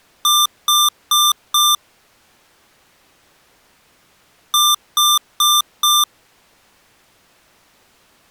Beep code, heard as beeps from a small speaker, played twice, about 1190 Hz. 4 short. In AMI BIOS tables: system timer failure; in Dell tables: memory read or write failure.